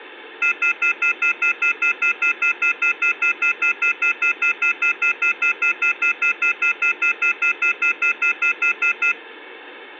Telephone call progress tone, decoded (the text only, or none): off-hook warning tone